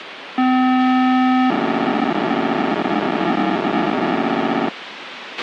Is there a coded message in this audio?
Yes: POCSAG pager data (512 baud) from 0.4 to 4.7 s, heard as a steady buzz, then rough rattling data, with radio hiss and a squelch burst at the end.